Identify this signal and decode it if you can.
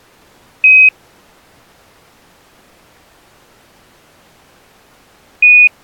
Quindar tones, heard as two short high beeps.